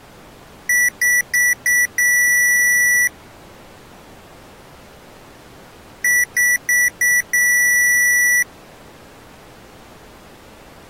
Beep code, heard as beeps from a small speaker, played twice, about 1950 Hz. 4 short, 1 long.